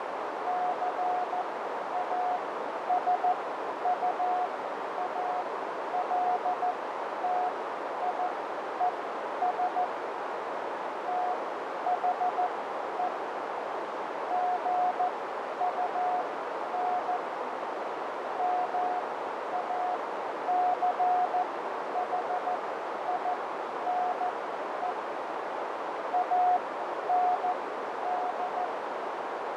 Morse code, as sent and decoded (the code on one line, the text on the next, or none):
-.-. .- ... ..- .- .-.. - .. . ... / - .... . / --. ..- -. / -- .- -.-. .... .. -. . / .- -. -..
CASUALTIES THE GUN MACHINE AND